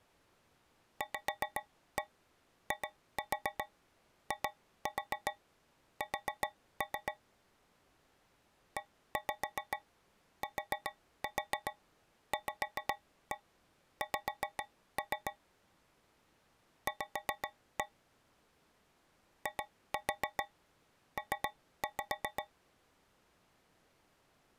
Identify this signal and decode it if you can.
Tap code, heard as taps on a metal pipe, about 7 knocks a second. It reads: VIIS ETVX V IP